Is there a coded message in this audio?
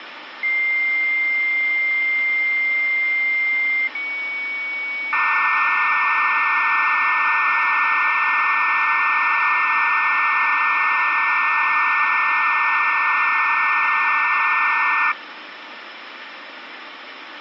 Yes: dial-up modem handshake (low-speed, two carriers) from 0.4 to 15.1 s, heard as two whistles, then hiss, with phone line noise.